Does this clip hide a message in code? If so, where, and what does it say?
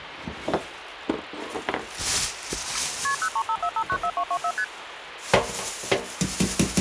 Yes: multi-frequency trunk signalling (R1, as on North American trunks) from 3.0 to 4.6 s, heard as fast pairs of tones, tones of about 70 ms, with phone line noise and kitchen noise. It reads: KP 0354594224 ST